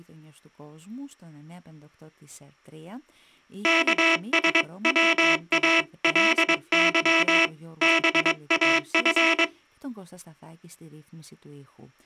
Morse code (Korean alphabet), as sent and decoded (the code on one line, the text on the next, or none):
-.- ... .-- .- .-.. -.-- / -... .- ..-.
여보게 돈